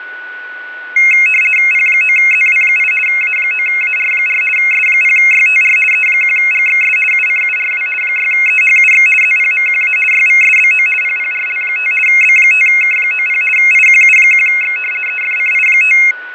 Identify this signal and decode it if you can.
RTTY (50 baud, 450 Hz shift), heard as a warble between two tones, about 2350 Hz centre, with fading and a steady whistle near 1480 Hz. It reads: P9ZW8 A9AR4 S0YTR E1GXS UCURW 6EHUX ZPMQA YVSBO PPRL5 B5K90 IQU1X EFCI5